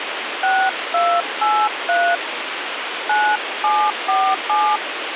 DTMF, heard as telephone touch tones, dialled by hand, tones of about 260 ms, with phone line noise. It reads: 6283 9747